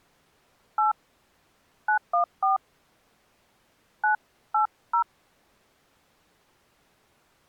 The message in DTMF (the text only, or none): 8 914 980